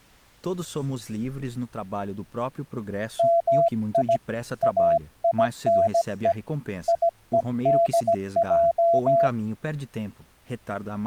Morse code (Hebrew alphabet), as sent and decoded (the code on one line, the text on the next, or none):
-- .. / .- .. -. . / .. . -.. .---
מי אינו יודע